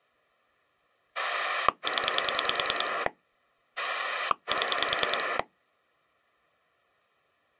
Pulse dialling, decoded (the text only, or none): 0 7